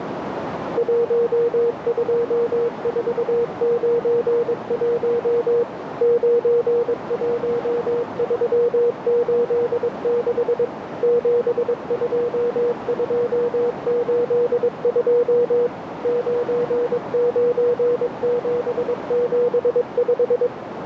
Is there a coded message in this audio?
Yes: Morse code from 0.7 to 20.5 s, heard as a keyed tone, machine-sent, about 22 wpm, 480 Hz, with radio static and a narrow filter. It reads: 12491 91386 72282 99775